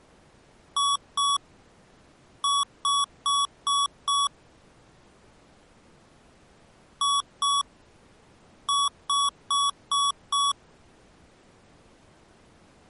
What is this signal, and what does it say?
Beep code, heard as beeps from a small speaker, played twice, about 1130 Hz. 2-5.